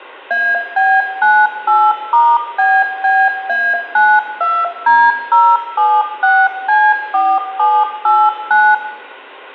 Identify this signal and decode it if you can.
DTMF, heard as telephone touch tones, dialled by machine, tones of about 240 ms, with room echo. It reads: AB98*BBA92D076C4789